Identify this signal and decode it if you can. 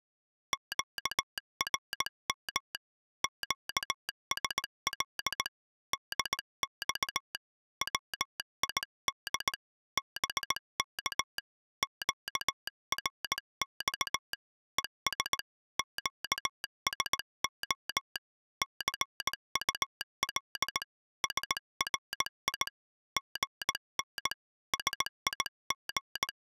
Morse code, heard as a telegraph sounder, hand-sent with a paddle, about 18 wpm. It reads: QRM QSL DX WID BK QRX ES QSO CUL SRI GN SIG